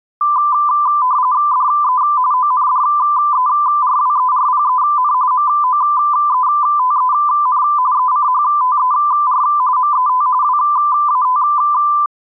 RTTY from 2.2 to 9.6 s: ONDERWERPEN MOETEN ECHTER

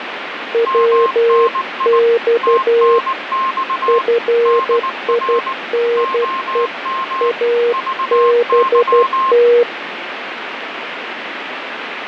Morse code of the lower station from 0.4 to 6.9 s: WX FINE

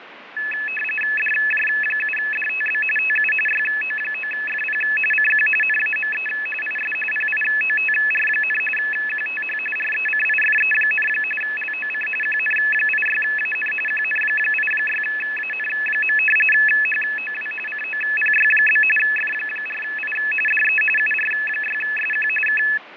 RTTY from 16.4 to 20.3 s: HOW COPY? F4I

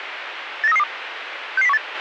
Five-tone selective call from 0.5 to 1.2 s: 89332

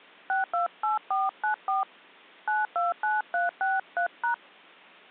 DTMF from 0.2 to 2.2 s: 628494

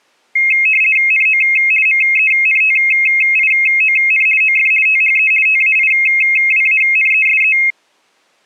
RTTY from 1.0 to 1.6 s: NO

